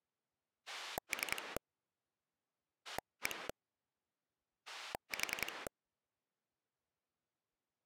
Pulse dialling, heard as a rotary dial, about 10 pulses a second. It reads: 3 1 4